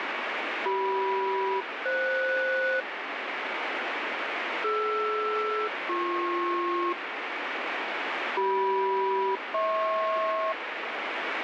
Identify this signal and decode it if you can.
Aircraft SELCAL, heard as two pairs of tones, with radio static. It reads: CM-FS DR-BP CM-HP